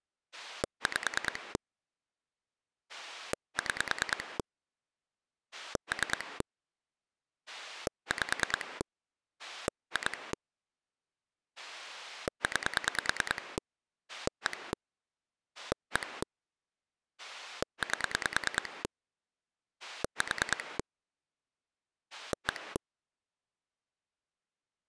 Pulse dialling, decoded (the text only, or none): 5 6 3 5 2 9 1 1 8 4 1